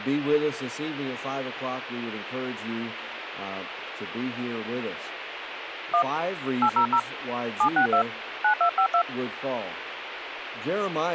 DTMF, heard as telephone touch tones, dialled by hand, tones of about 90 ms, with radio hiss. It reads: 1 800 762 9252